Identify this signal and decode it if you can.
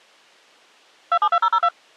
DTMF, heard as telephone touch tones, dialled by machine, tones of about 60 ms. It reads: 272002